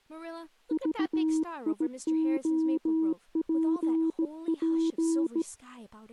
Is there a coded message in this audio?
Yes: Morse code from 0.7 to 5.5 s, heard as a keyed tone, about 17 wpm, 320 Hz, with speech in English. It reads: VIOPP